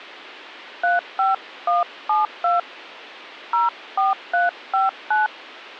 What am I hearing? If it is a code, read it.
DTMF, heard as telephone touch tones, dialled by hand, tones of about 160 ms. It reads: 35172 04359